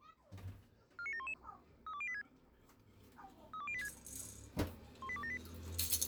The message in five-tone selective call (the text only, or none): 49711 32086 32086 18278